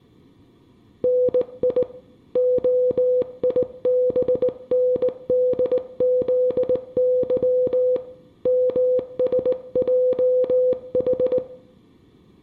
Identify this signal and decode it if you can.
Morse code, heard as a keyed tone, hand-sent with a straight key, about 19 wpm, 500 Hz, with room echo. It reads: NI OIBNDZY MSJH